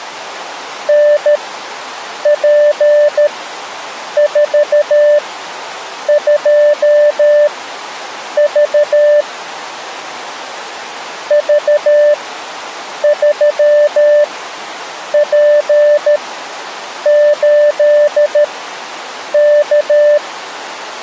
Morse code, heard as a keyed tone, machine-sent, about 13 wpm, spaced as for 7 wpm, 590 Hz. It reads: NP42V V3P8K